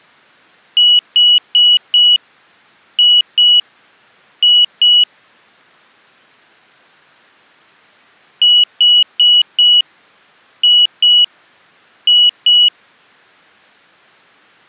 Beep code, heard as a piezo beeper, played twice, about 2950 Hz. 4-2-2. In Phoenix BIOS tables: shutdown test failure.